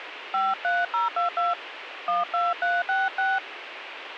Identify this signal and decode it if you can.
DTMF, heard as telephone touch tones, dialled by hand, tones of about 180 ms, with radio hiss. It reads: 53022 12366